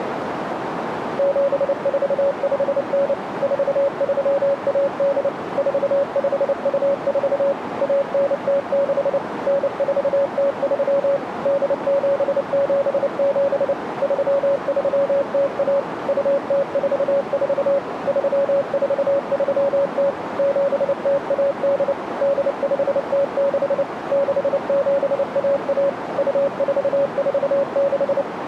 Morse code (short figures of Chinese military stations), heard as a keyed tone, machine-sent, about 29 wpm, 560 Hz, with radio static and a narrow filter. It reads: 7459 4318 4524 1906 9403 8777 3301 2044 3430 7018 8506 6711 2446